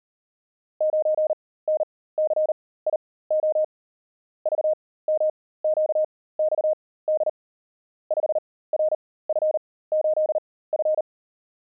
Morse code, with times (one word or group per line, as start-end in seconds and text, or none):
0.8-3.6 9NCIO
4.5-7.3 VMQXD
8.1-11.0 5RF8F